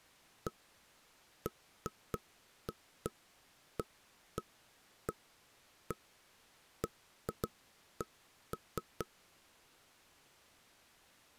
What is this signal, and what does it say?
Irregular knocks on wood. There is no code.